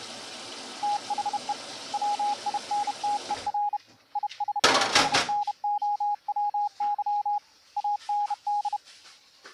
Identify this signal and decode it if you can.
Morse code, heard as a keyed tone, hand-sent with a bug key, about 31 wpm, 830 Hz, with kitchen noise. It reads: THE WINTER IS SNOWY AND